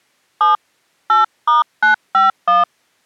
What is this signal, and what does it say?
DTMF, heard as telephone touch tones, dialled by hand, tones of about 140 ms. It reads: 7 8*951